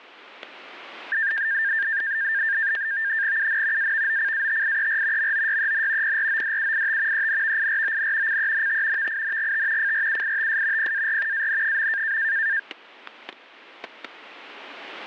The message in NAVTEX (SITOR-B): UN AVOCATIER MOYEN PRODUIT ENVIRON CENT VINGT FRUITS PAR AN.

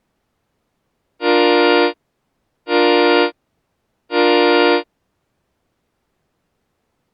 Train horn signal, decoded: 3 short

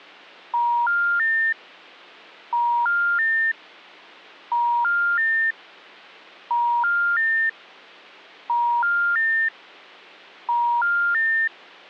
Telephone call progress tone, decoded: special information tone

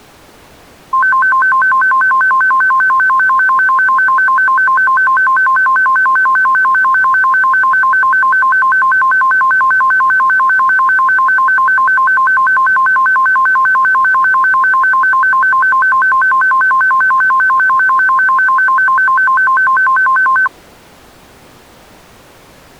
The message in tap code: none

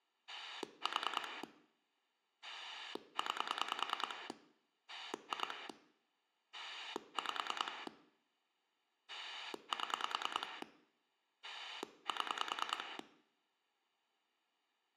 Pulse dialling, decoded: 4 9 2 5 7 7

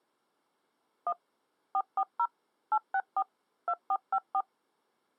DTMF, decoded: 1 440 864 2454

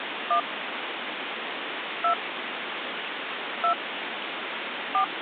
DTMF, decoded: 1 2 2 4

